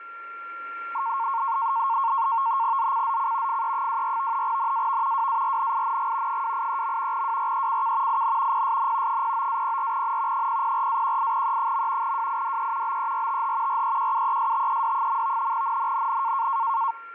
NAVTEX (SITOR-B), 100 baud, 170 Hz shift, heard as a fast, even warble, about 1000 Hz centre, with a steady whistle near 1380 Hz. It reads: ZCZC FE24 NAV WARNING 283. WRECK IN PSN 09-04N 004-18E. WIDE BERTH REQUESTED. NNNN